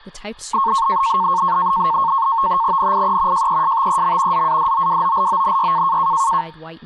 NAVTEX (SITOR-B), 100 baud, 170 Hz shift, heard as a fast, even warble, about 1000 Hz centre, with speech in English. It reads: NIE JESTEM ZADOWOLONY